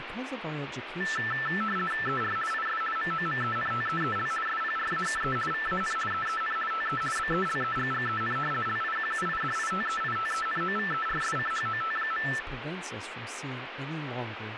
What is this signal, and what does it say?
RTTY (50 baud, 450 Hz shift), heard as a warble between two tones, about 1550 Hz centre, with radio static and speech in English. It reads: ER IS MOMENTEEL SPRAKE VAN EEN TE BELEGGEN LIQUIDITEITENOVERSCHOT.